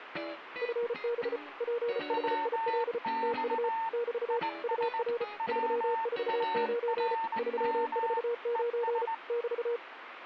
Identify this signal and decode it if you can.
Morse code, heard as two keyed tones, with radio static. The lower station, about 34 wpm, 470 Hz: FB PHIL TU <BT> UR 349 349 <BT>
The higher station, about 19 wpm, 900 Hz: WX IS WARM ES